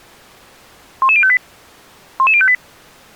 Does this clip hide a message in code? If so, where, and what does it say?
Yes: five-tone selective call (ZVEI) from 1.0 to 2.5 s, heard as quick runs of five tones, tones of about 70 ms. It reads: 11058 11058